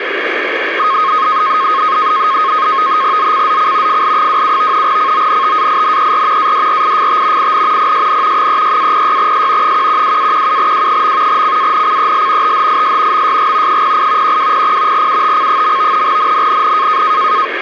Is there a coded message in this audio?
Yes: NAVTEX (SITOR-B), 100 baud, 170 Hz shift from 0.8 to 17.5 s, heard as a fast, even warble, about 1170 Hz centre, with radio static. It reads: ZCZC FL27 CONTAINER ADRIFT IN PSN 36-06S 112-17W. CANCEL THIS MSG 08 1200 UTC. NNNN